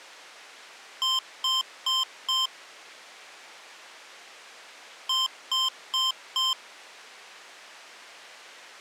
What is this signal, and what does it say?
Beep code, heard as beeps from a small speaker, played twice, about 1040 Hz. 4 short. In AMI BIOS tables: system timer failure; in Dell tables: memory read or write failure.